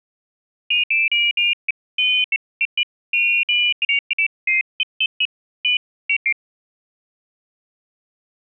Pairs of high tones at irregular times. There is no code.